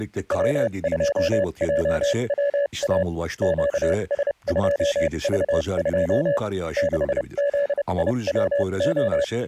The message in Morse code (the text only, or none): W2JWA QS2V2 6ZIWO